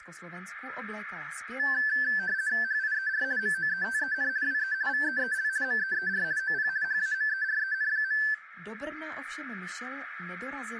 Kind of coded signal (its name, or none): RTTY